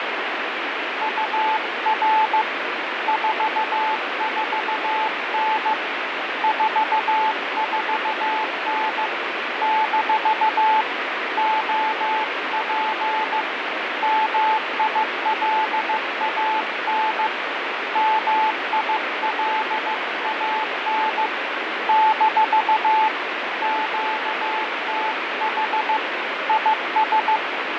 Morse code, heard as a keyed tone, hand-sent with a paddle, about 15 wpm, 870 Hz, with heavy radio static and fading. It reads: UR 44N 44N - OP MILAN MILAN - QTH IS